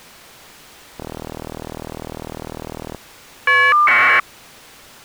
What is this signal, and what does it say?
Caller ID data burst, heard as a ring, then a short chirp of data, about 1200 baud.